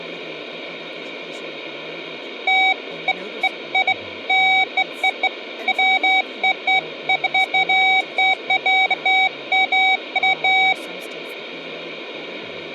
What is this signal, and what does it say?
Beeps of irregular length, with speech in English. There is no code.